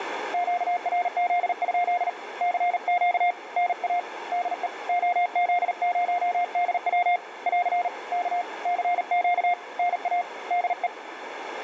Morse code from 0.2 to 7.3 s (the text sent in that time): QRZ? CQ NA DE OZ0DW